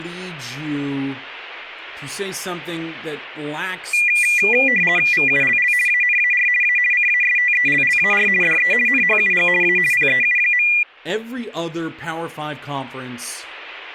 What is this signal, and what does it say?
RTTY (50 baud, 450 Hz shift), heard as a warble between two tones, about 2200 Hz centre, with speech in English. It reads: VULL ANAR A CASTELLAR DE NHUG A PEU.